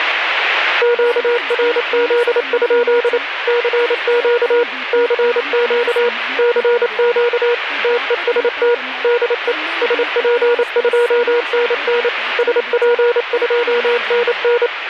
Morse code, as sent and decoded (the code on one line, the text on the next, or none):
--.- .-. --.. ..--.. / -.-. --.- / -.-. --.- / -.-. --.- / - . ... - / -.. . / ... .--. ..--- -. -. / ... .--. ..--- -. -.
QRZ? CQ CQ CQ TEST DE SP2NN SP2NN